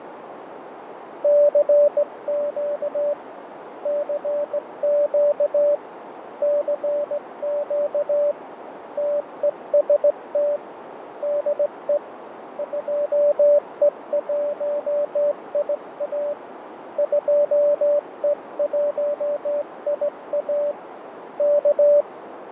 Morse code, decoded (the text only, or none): CQ CQ CQ TEST DE 2E1IA 2E1IA K